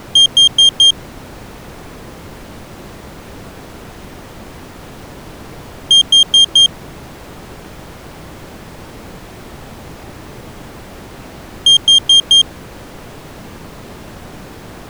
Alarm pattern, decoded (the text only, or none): temporal four